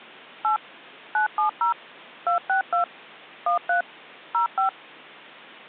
DTMF, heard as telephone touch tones, dialled by machine, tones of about 120 ms. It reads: 8 970 262 13 05